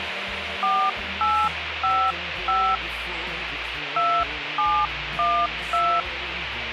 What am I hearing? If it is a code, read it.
DTMF, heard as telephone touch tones, dialled by hand, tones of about 270 ms, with phone line noise. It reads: 4855 2712